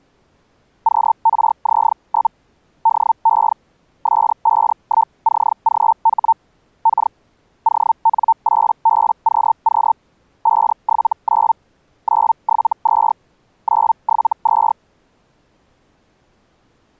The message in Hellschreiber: QRZ? DE S51CGH K ON8BQQ 579 972 972

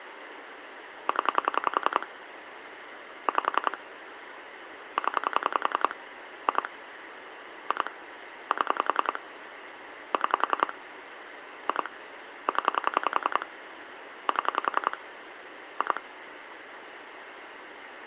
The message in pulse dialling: 0 5 0 2 2 7 6 2 0 7 2

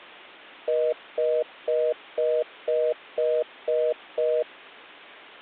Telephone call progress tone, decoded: congestion tone

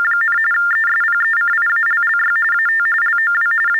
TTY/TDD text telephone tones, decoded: … ESPECIALLY AT LOW …

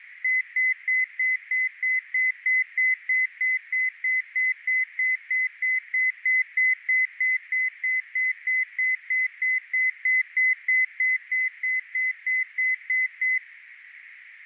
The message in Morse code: none

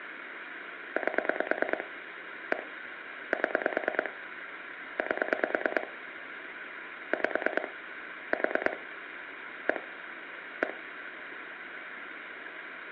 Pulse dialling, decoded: 8 1 7 8 5 4 1 1

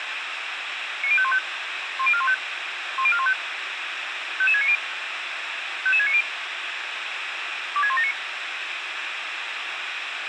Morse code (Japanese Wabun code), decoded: none

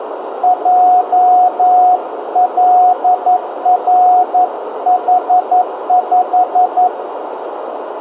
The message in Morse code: JLRH5

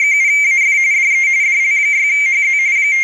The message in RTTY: … DE DL6HZ …

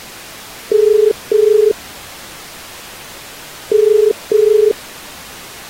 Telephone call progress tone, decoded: ringback tone

